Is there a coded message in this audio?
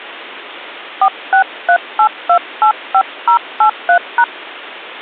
Yes: DTMF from 1.0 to 4.2 s, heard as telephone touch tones, dialled by hand, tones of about 80 ms. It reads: 4638285083#